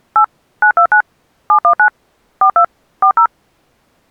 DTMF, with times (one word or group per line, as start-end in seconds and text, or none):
0.2-0.2 8
0.6-1.0 929
1.5-1.9 719
2.4-2.6 42
3.0-3.3 40